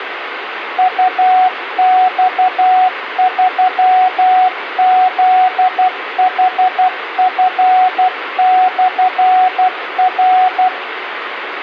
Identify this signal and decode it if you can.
Morse code, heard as a keyed tone, machine-sent, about 12 wpm, 740 Hz, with radio hiss and room echo. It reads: UX3ZHF/R